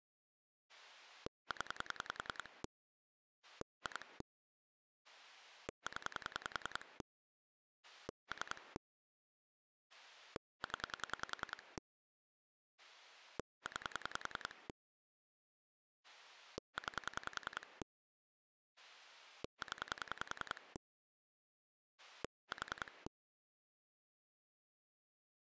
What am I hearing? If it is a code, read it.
Pulse dialling, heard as a rotary dial, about 10 pulses a second. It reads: 0 2 0 3 0 9 9 0 4